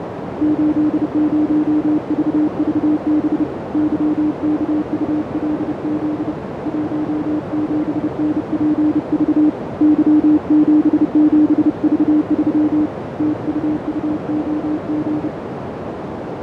Morse code, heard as a keyed tone, hand-sent with a paddle, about 30 wpm, 300 Hz, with heavy radio static, fading and a narrow filter. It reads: 80VVB YKULZ 17NPV Y77V3 TUUOG